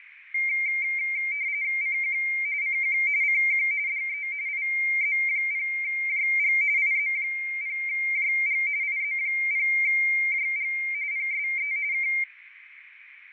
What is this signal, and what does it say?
RTTY (45.45 baud, 170 Hz shift), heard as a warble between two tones, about 2200 Hz centre, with radio static, fading and a narrow filter. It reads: CQ CQ CQ DE IZ0JG IZ0JG IZ0JG PSE K